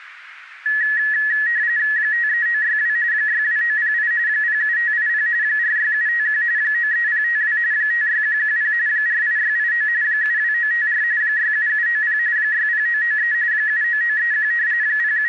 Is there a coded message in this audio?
Yes: RTTY (45.45 baud, 170 Hz shift) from 0.7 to 15.3 s, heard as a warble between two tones, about 1800 Hz centre, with radio static. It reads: 53962 62908 07580 46751 93052 56110 48689 72954 67790 60993 79931 …